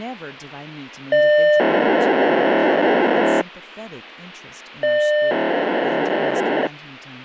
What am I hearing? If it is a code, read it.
POCSAG pager data (1200 baud), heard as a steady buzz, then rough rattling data, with speech in English.